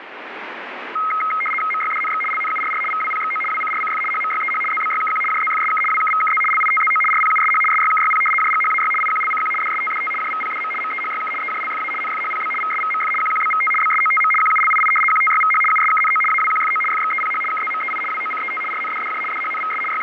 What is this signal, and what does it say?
RTTY (75 baud, 850 Hz shift), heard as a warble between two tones, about 1700 Hz centre, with radio static. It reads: MYDNX LNURR VWPXO WCRCF HMYEH ZBYKQ JZFSK WKVKZ LITZO RPUSH SYKYP JGHAY IQLCQ DSTDT JVPDM MEHYK EJLFA NFHPB VSVMF QQBVT BSOTM QULII QTYVH USKNO AWQFO FXEPH KZMEI WOCET RNDDJ DHNVS …